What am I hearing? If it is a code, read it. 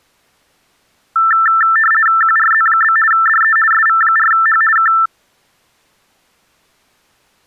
RTTY (50 baud, 450 Hz shift), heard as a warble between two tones, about 1550 Hz centre. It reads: QRZ? DE SV4H K